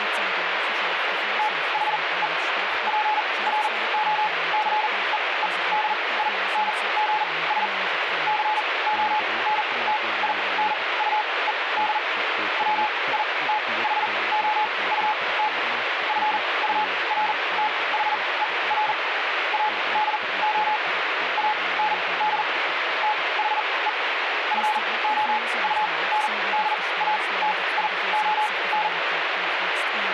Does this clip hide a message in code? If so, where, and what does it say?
Yes: Morse code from 1.3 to 28.9 s, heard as a keyed tone, machine-sent, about 40 wpm, spaced as for 23 wpm, 850 Hz, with radio static. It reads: THE PROCEEDINGS CONTINUED WITHOUT FURTHER ADO AND THE FOUNDATION